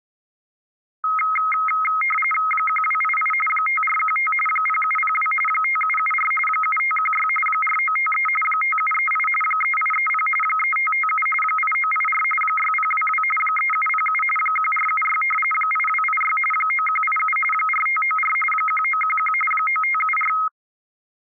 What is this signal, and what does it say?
RTTY (45.45 baud, 850 Hz shift), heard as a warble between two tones, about 1700 Hz centre. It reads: 1288 5415 0702 5774 7516 4953 5738 3830 3557 8984 6022 3707 1476 8286 9187 4594 1911 9574